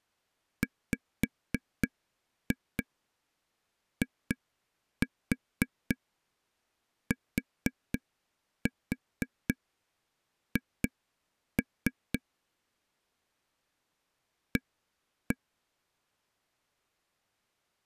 Tap code, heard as taps on a table, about 4 knocks a second. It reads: WITH A